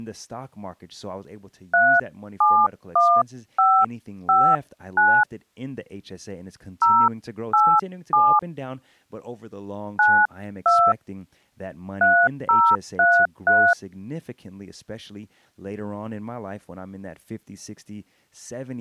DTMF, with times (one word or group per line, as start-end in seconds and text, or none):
1.7-5.2 371559
6.8-8.4 087
10.0-10.9 92
12.0-13.7 3033